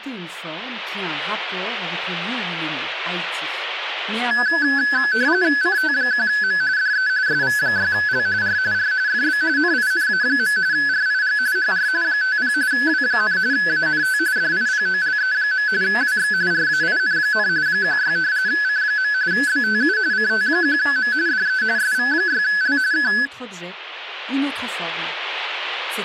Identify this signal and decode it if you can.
RTTY (45.45 baud, 170 Hz shift), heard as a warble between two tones, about 1600 Hz centre. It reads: CT1M DE SV6L R R FB NINA. RIG HR 50 W, ANT DIPOLE. WX RAIN, 16 C. BTU CT1M DE SV6L K